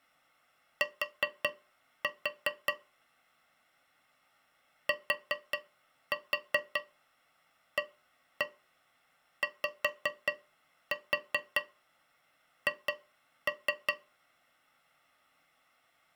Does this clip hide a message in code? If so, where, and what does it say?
Yes: tap code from 0.8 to 14.0 s, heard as taps on a metal pipe, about 5 knocks a second. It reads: T TAYH